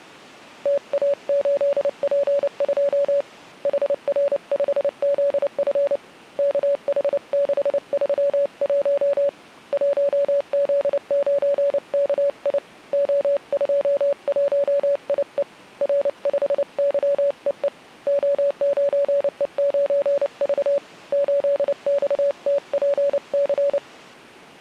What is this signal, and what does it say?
Morse code, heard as a keyed tone, hand-sent with a paddle, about 29 wpm, 570 Hz. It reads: TA8P2 HR5ZF KH631 1Z9KI O21IE R5YEE O9E9V 8XTPC